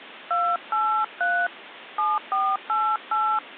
DTMF, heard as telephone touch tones, dialled by hand, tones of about 260 ms, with phone line noise. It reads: 283 7488